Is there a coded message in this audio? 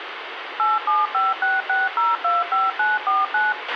Yes: DTMF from 0.6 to 3.5 s, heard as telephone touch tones, dialled by machine, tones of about 180 ms, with radio hiss and a squelch burst at the end. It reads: 87566025949